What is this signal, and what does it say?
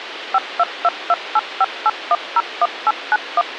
DTMF, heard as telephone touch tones, dialled by machine, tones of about 40 ms, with radio hiss and a squelch burst at the end. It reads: 5222858101891